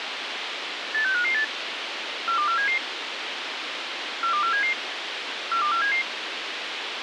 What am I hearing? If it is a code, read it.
Five-tone selective call (CCIR), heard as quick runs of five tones, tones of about 100 ms, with radio hiss. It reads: 86558 42477 42477 42477